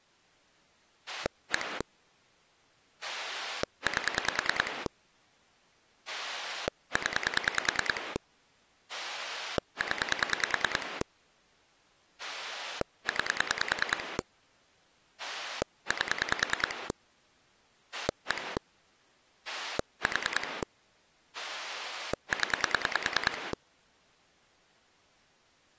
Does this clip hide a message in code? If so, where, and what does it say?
Yes: pulse dialling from 1.1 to 23.5 s, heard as a rotary dial, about 10 pulses a second. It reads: 1 8 0 0 9 8 1 4 0